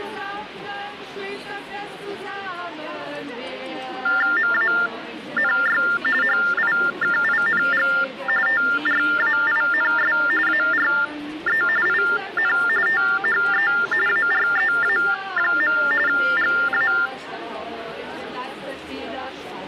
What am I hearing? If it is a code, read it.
TTY/TDD text telephone tones (45.45 baud Baudot), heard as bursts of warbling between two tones, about 400 Hz shift, 1600 Hz centre. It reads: MANY HIKING TRAINS ARE IN THE AREA. GA